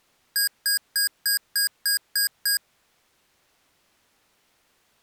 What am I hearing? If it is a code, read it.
Beep code, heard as beeps from a small speaker, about 1650 Hz. 8 short. In AMI BIOS tables: display memory failure; in Dell tables: LCD failure.